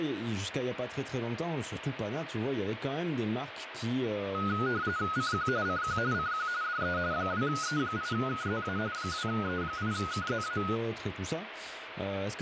RTTY (45.45 baud, 170 Hz shift), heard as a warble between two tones, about 1360 Hz centre, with radio static and speech in French. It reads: CQ CQ CQ DE 2E8KZA 2E8KZA